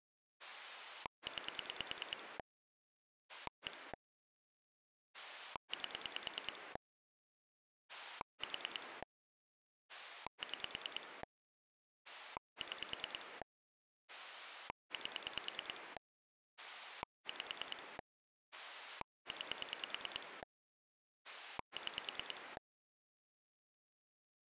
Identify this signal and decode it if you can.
Pulse dialling, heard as a rotary dial, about 9 pulses a second. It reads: 9 1 8 4 6 6 8 5 9 6